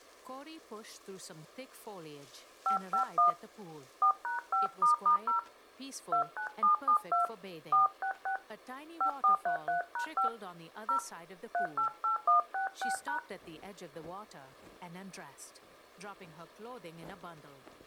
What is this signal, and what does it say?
DTMF, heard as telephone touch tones, dialled by hand, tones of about 120 ms. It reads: 551 4#5**0 29772 466 5433#5 0 388166#